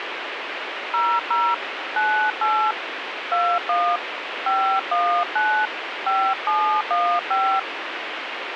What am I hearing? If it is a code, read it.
DTMF, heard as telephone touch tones, dialled by hand, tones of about 290 ms, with radio hiss. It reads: 00 98 21 519 5715